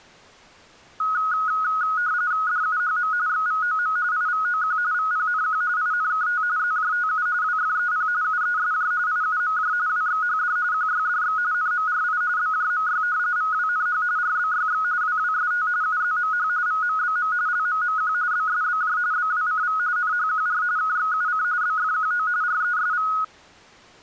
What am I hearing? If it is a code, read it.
RTTY (45.45 baud, 170 Hz shift), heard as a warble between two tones, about 1360 Hz centre. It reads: DUHM XVOM IVOQ VPNQ INKT ZJTU WFEP UESJ IUMJ WXHD QYDX NMRI BJMY VWNH RBYX WWST UZMH VMBM LMMQ BSBJ BWCV NHQR KXUC BFQO RESV